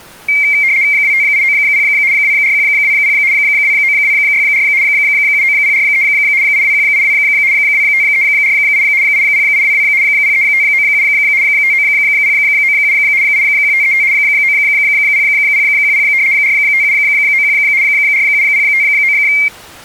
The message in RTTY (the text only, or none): 25890 24120 29264 79043 82182 25348 80822 03597 59097 81535 90010 45791 47059